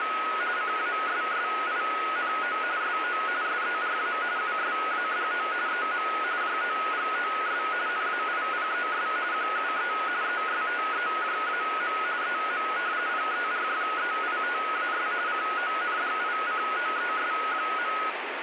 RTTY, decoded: … CASSINO SO SERA USADO EM JOGOS NAIPES QUE ESTEJAM EM PERFEITAS CONDICOES.

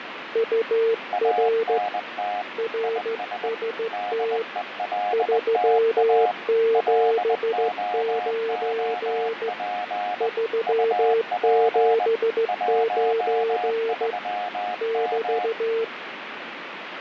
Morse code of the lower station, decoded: UR RST 379 379 <BT>

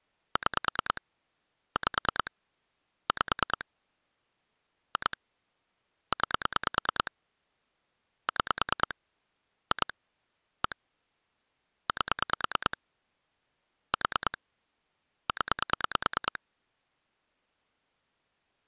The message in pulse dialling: 6 5 5 2 9 6 2 1 8 4 0

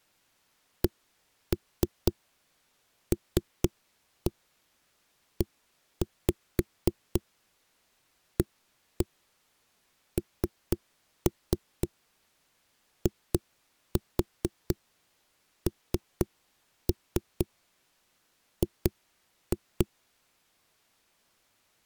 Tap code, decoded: CLEANING

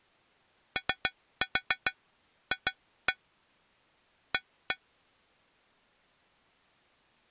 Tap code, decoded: OF A

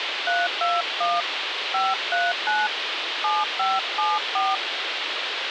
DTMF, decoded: 321 539 7574

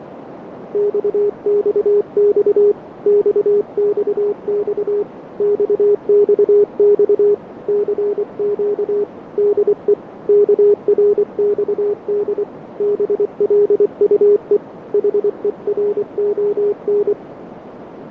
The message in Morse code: XXX XXX XXX CQ DE KRXD BLUE HERON

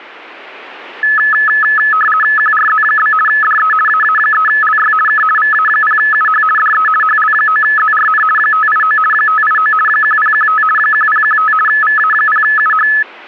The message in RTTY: QRZ? DE AA3LY K VA0UH DE HL9ZRN 589 589 1015 1015 VA0UH

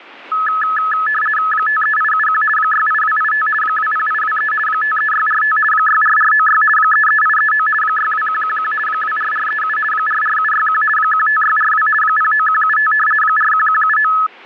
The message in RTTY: 53871 68285 20823 53645 64496 33839 62111 24437 44761 15642 09175 41179

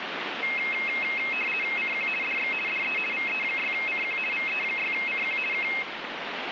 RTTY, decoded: CQ DX DE VE6CQ VE6CQ K

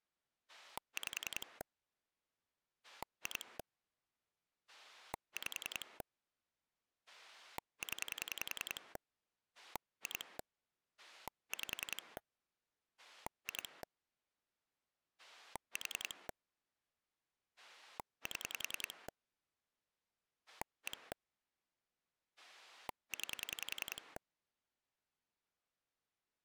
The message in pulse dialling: 5 2 5 0 2 5 2 4 7 1 9

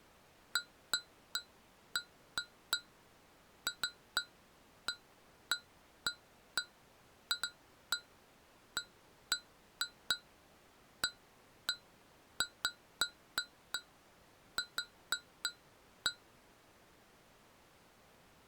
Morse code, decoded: none

